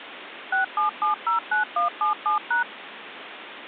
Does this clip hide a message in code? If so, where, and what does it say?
Yes: DTMF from 0.5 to 2.6 s, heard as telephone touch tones, dialled by machine, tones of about 120 ms, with phone line noise. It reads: 67709177#